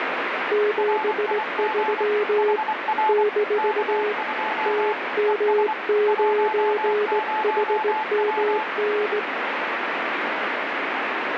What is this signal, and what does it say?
Morse code, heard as two keyed tones, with heavy radio static. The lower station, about 18 wpm, 420 Hz: 73 - TM9HMN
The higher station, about 24 wpm, 870 Hz: RIG HR K2 ES 10W